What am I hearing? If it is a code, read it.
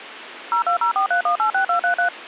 DTMF, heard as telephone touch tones, dialled by machine, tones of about 100 ms, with phone line noise. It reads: 02043186233